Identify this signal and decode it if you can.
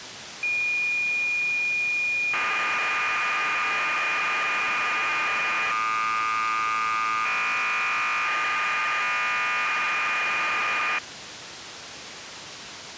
Cassette data (Kansas City type), 1200 baud, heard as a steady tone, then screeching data, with tape hiss.